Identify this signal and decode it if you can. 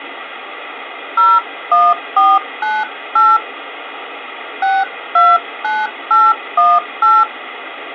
DTMF, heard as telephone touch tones, dialled by hand, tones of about 220 ms, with phone line noise. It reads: 01498 629818